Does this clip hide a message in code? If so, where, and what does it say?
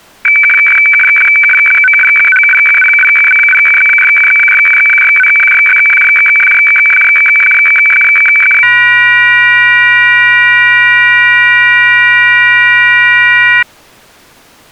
Yes: weather fax (radiofax), 120 lines a minute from 0.2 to 13.6 s, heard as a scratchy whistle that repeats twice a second.